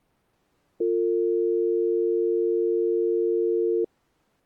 Telephone call progress tone (North American or UK plan), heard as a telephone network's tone, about 350, 450 Hz. Dial tone.